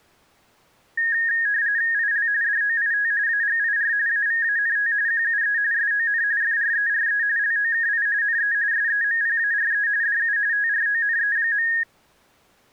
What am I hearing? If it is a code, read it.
RTTY (45.45 baud, 170 Hz shift), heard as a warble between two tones, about 1750 Hz centre. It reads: IL DOIT AGIR AVANT QUE SON FRERE LOKI NE SEMPARE DU TRONE.